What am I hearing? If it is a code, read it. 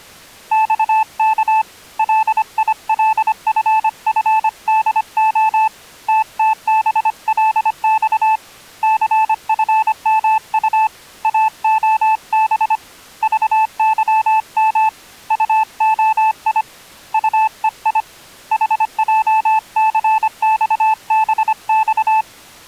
Morse code, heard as a keyed tone, hand-sent with a paddle, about 25 wpm, 880 Hz. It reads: XK LILFFDO TTBLX CFMU AOB VYM UOI UEI HJCXBX